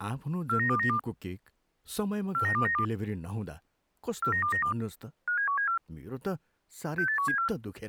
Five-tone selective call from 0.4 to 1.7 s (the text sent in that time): 49292